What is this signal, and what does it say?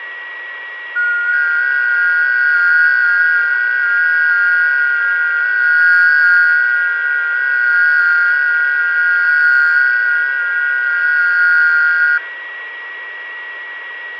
FT8 (several signals at once), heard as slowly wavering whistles, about 6.25 baud, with a steady whistle near 1920 Hz and room echo.